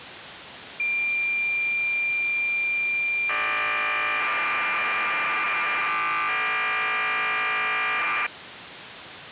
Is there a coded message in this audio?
Yes: cassette data (Kansas City type), 1200 baud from 0.8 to 8.3 s, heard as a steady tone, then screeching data, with tape hiss.